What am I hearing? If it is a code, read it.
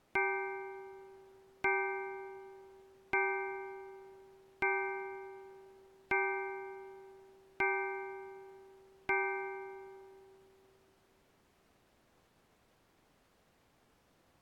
Clock strike, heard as a bell. 7. Seven o'clock.